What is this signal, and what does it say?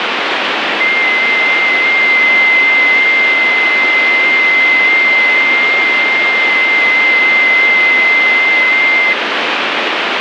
FT8 (one signal), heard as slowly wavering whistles, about 6.25 baud, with radio static.